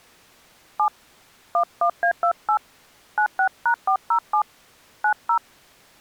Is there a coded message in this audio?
Yes: DTMF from 0.8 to 5.4 s, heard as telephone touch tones, dialled by hand, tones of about 90 ms. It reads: 7 11A28 96#407 90